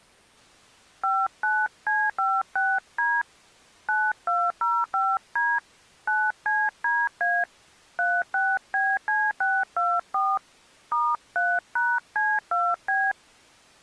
DTMF, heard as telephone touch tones, dialled by hand, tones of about 230 ms. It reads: 59C56D 9205D 9CDA 36BC624 *3#C2B